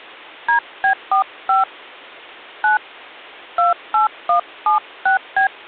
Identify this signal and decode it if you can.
DTMF, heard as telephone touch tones, dialled by hand, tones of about 110 ms. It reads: DB45 9 28176B